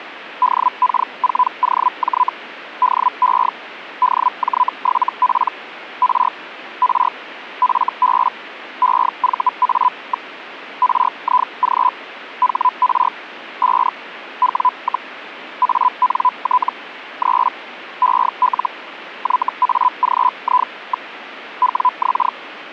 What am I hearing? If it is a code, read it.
Hellschreiber (Feld-Hell, 122.5 baud), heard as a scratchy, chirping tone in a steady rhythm, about 1000 Hz. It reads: DK4OJ DE DJ7P R R FB EVA. RIG HR 5 W, ANT 3 EL YAGI. WX